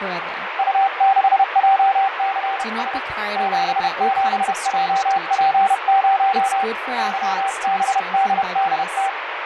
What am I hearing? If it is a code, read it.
Morse code, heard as a keyed tone, hand-sent with a paddle, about 31 wpm, 780 Hz, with radio static, fading and speech in English. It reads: U6JCS 77JP0 YBDDT